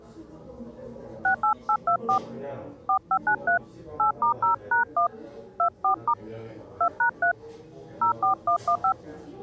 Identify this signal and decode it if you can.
DTMF, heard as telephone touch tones, dialled by hand, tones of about 100 ms, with the noise of a crowd indoors. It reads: 68824 4593 8*0#1 24* 2#3 04115